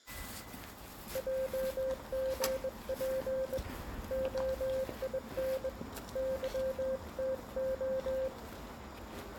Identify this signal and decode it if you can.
Morse code, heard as a keyed tone, hand-sent with a bug key, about 21 wpm, 530 Hz, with the noise of a residential street. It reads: JGP OIN YTO